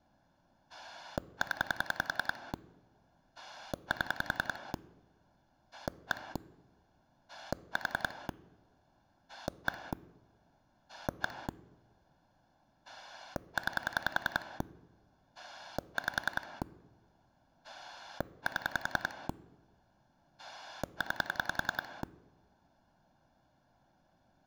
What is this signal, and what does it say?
Pulse dialling, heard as a rotary dial, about 10 pulses a second. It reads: 0 7 1 4 1 1 9 5 7 9